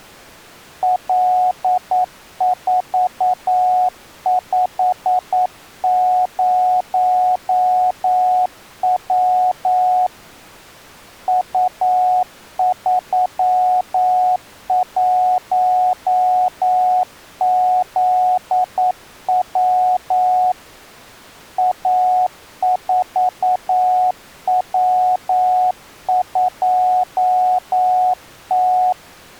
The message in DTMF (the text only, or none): none